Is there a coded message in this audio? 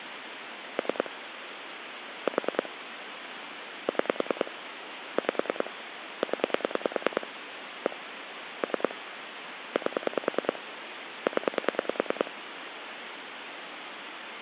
Yes: pulse dialling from 0.8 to 12.3 s, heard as clicks on a phone line, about 10 pulses a second, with phone line noise. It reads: 3 4 6 5 0 1 3 8 0